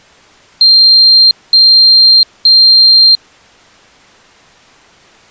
Beep code, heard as a piezo beeper, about 4200 Hz. 3 long. In IBM BIOS tables: keyboard card error.